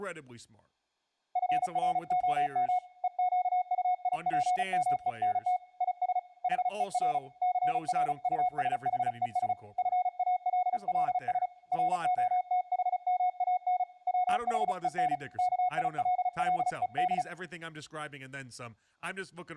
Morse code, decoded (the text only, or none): FROM EQUIPMENT IS HER CRUSHES FALLS ROTHMAN WHEN KILLED